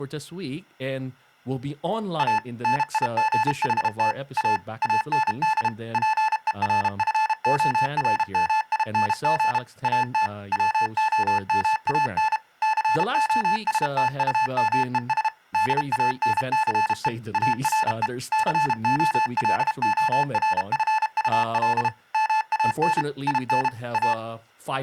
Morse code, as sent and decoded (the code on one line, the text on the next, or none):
.- / -. .. --. .... - / .- / .- -. -.. / .--. . .-. ..-. --- .-. -- .. -. --. / .- - / .-- --- -- .- -. / -.-. --- ... - ..- -- . ... / -.. .- -. -.-. . / .- .-. . / -.-. --- .-.. --- .-. ..-. ..- .-.. / -- .- -. / .. -. / .-
A NIGHT A AND PERFORMING AT WOMAN COSTUMES DANCE ARE COLORFUL MAN IN A